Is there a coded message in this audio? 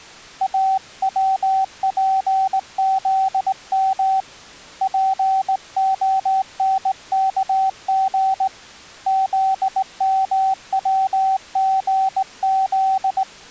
Yes: Morse code (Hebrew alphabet) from 0.4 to 13.3 s, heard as a keyed tone, hand-sent with a straight key, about 19 wpm, 770 Hz. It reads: אצפזם פהנכג זמצגז